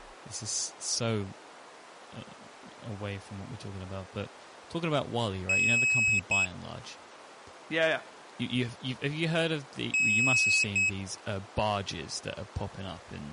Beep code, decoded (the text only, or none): 1 long, 1 short